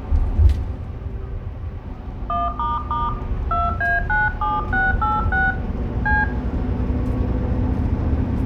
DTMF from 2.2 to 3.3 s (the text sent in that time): 1**